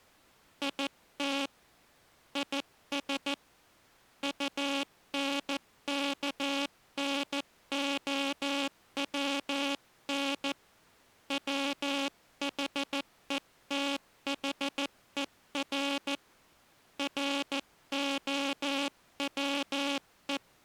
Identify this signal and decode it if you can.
Morse code, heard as a buzzer, hand-sent with a paddle, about 14 wpm. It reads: IT IS UNKNOWN WHETHER ROWE